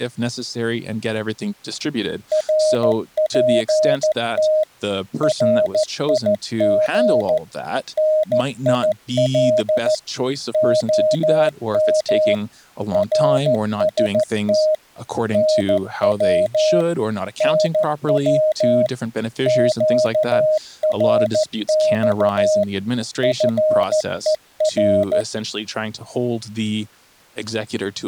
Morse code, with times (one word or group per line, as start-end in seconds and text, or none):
2.3-4.6 RPT
5.2-7.4 RIG
8.0-9.9 NIL
10.5-12.3 OM
12.9-14.7 RST
15.3-16.8 NW
17.4-18.9 NW
19.5-22.6 QRX
23.2-25.2 FER